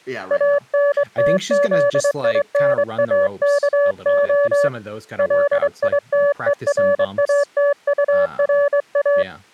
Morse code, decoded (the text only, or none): ANTZINAKO LITERATURA